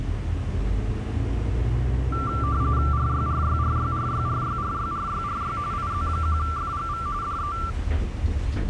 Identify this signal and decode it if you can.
RTTY (45.45 baud, 170 Hz shift), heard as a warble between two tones, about 1260 Hz centre, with the noise inside a bus. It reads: RYRYRYRYRYRYRYRY IZ1FGV DE